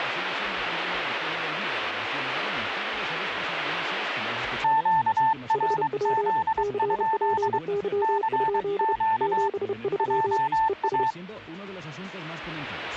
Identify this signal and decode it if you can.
Morse code, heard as two keyed tones. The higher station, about 23 wpm, 890 Hz: QRZ? CQ JA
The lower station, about 31 wpm, 400 Hz: HW CPY? 73 ES